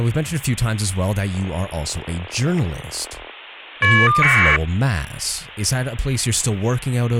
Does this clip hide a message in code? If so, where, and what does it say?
Yes: caller ID data burst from 1.3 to 4.6 s, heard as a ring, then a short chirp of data, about 1200 baud, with hum and speech in English.